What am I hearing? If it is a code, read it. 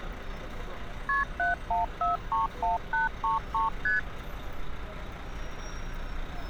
Multi-frequency trunk signalling (R1, as on North American trunks), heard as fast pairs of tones, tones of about 150 ms, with street noise. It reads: KP 71431833 ST